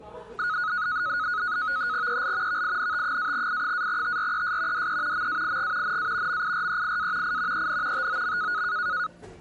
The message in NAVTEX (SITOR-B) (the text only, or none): EL VINT-I-TRES DE MAIG NA MIREIA I EN TOM